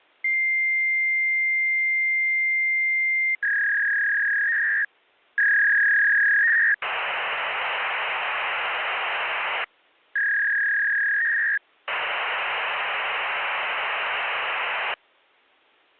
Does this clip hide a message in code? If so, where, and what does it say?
Yes: fax machine handshake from 0.2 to 14.9 s, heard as a long tone, a warble and hiss.